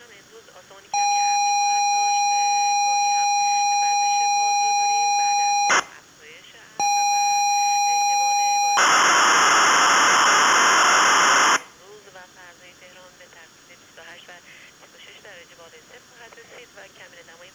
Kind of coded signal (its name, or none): ZX Spectrum tape loading